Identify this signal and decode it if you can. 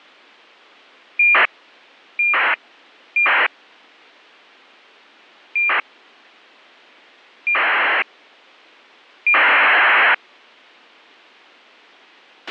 ACARS aircraft data, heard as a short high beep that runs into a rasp, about 2400 baud, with a squelch burst at the end.